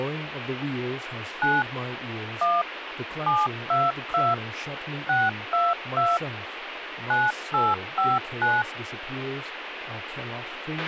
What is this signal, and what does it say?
DTMF, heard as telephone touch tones, dialled by machine, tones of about 200 ms, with radio hiss, a squelch burst at the end and speech in English. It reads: 9 1 722 622 9859